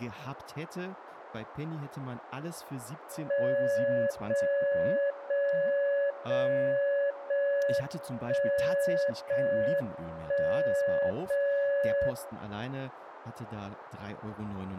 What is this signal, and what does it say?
Radio time signal (JJY), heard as a tone whose level steps once a second, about 560 Hz, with radio static and speech in German. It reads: 0 0 0 0 1 0 1 0 0